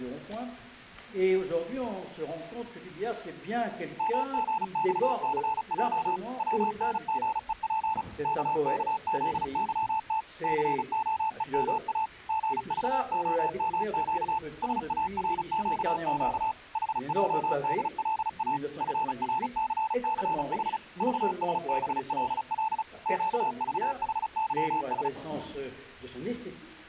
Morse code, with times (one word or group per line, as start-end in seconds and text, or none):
4.0-6.2 MGXCJ
6.4-8.0 WNGEP
8.2-10.2 KKZYT
10.4-12.1 COEMA
12.3-14.4 GVOMQ
14.6-16.5 SARQQ
16.8-18.6 HJDLA
18.8-20.8 FRCCH
21.0-22.8 VSBLL
23.1-25.1 QVHYS